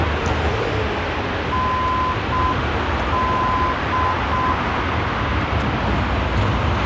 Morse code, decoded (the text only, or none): ND